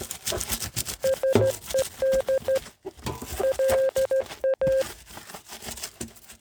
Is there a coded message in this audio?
Yes: Morse code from 1.0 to 4.9 s, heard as a keyed tone, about 15 wpm, 530 Hz, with kitchen noise. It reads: SED LA